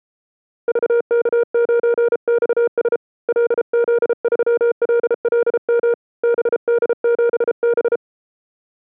Morse code, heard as a keyed tone, hand-sent with a paddle, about 33 wpm, 470 Hz. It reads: VK9XS LZ3LLM BD7B